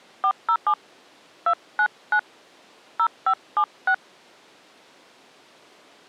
DTMF, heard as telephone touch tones, dialled by hand, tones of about 70 ms. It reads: 407 299 0576